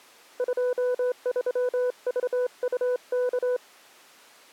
Morse code, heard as a keyed tone, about 28 wpm, 500 Hz. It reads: 23VUK